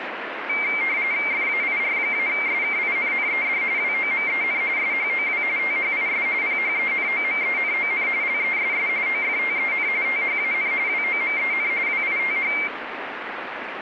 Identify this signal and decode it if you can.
RTTY (45.45 baud, 170 Hz shift), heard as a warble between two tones, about 2200 Hz centre, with radio static. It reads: FAIR-SKINNED WOMEN SHOW THIS PHENOMENON LESS OFTEN THAN WOMEN WITH